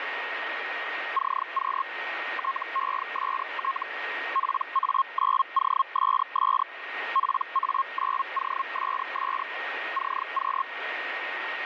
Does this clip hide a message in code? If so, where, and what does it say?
Yes: Hellschreiber (Feld-Hell, 122.5 baud) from 1.1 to 10.6 s, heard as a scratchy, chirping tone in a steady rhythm, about 1080 Hz, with radio static and a steady whistle near 1860 Hz. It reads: CQ TEST PA9OSS PA9OSS CQ